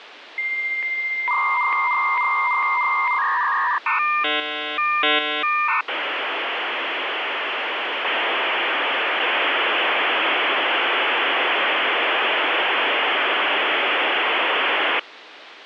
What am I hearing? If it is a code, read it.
Dial-up modem handshake (V.34 or later), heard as a whistle, warbles, then hiss, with phone line noise.